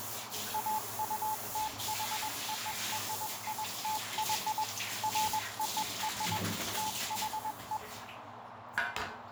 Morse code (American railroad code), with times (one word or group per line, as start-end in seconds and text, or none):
0.5-4.6 AUTHORITY
5.0-6.4 FOR
6.8-7.8 THE